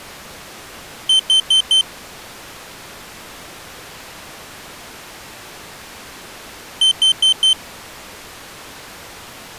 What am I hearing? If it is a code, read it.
Alarm pattern, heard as an alarm's beeps, played twice, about 3100 Hz. Temporal four. Carbon monoxide.